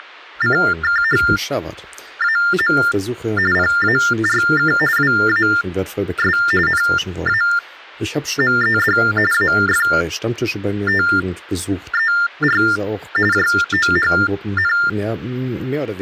TTY/TDD text telephone tones (45.45 baud Baudot), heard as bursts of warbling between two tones, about 400 Hz shift, 1600 Hz centre, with speech in German. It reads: … PARK WAS NAMED AFTER JOHN